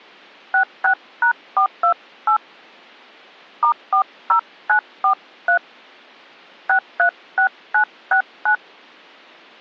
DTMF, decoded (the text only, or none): 66#428 *40943 636969